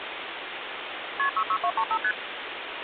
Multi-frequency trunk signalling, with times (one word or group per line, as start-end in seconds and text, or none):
1.2-1.3 KP
1.4-2.0 66235
2.0-2.1 ST